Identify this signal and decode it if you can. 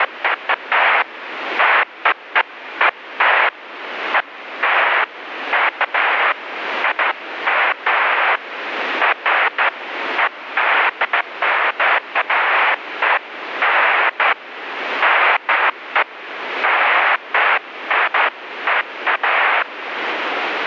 Bursts of noise, with radio static. There is no code.